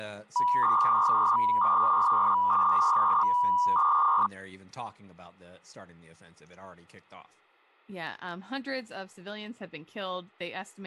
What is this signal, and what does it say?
300-baud modem data (V.21 tones), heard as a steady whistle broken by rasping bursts, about 300 baud, 200 Hz shift, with speech in English.